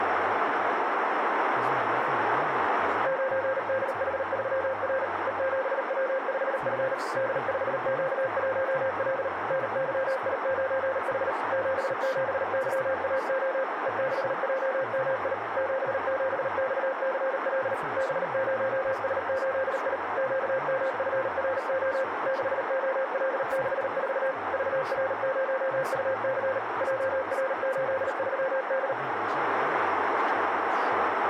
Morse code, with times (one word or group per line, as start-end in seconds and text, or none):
3.1-5.0 9DH3R
5.3-6.9 E7W5F
7.2-9.3 D5Q1L
9.5-11.3 NYI9H
11.5-13.6 77YAO
13.9-15.3 E6JMI
15.6-17.7 77XCL
18.0-20.0 B0S8I
20.2-22.0 QMFRO
22.3-24.3 6OL64
24.5-26.6 VR0UC
26.8-28.9 JR83D